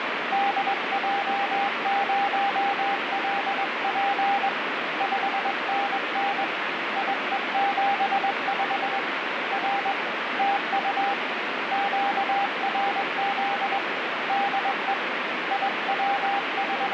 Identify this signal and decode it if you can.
Morse code, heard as a keyed tone, hand-sent with a straight key, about 21 wpm, 800 Hz, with heavy radio static. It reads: DJ0LP 5NN IE75 R TU QRZ DE …